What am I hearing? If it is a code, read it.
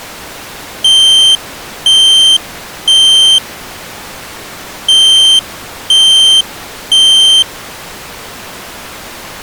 Alarm pattern, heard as an alarm's beeps, played twice, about 3150 Hz. Temporal three. Smoke or fire, evacuate.